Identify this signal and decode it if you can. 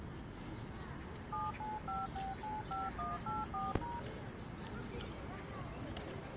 DTMF, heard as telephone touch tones, dialled by machine, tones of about 180 ms, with phone line noise and the noise of a park. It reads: 795695184#